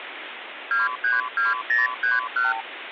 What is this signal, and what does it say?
Multi-frequency trunk signalling (R2, with the far end's replies), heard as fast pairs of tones, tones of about 160 ms, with phone line noise. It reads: 232031